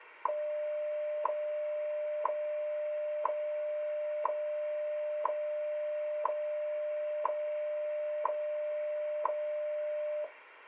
Radio time signal (WWV, Colorado), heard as ticks, one a second.